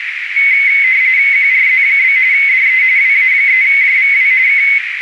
RTTY (45.45 baud, 170 Hz shift), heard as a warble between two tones, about 2150 Hz centre, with radio static and a narrow filter. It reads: QRZ? DE WA3JVW K